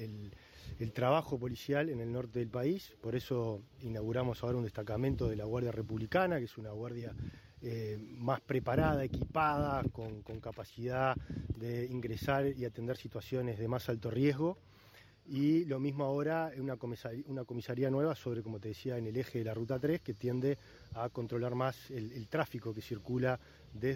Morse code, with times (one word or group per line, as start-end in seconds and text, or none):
none